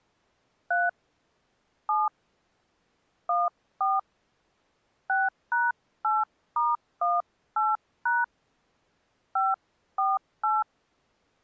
DTMF, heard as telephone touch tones, dialled by hand, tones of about 190 ms. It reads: 3 7 14 6#8*18# 548